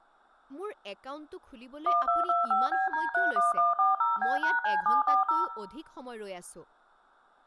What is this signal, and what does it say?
DTMF, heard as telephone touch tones, dialled by machine, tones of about 160 ms, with room echo and speech in Assamese. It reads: 1225BD31140B#C740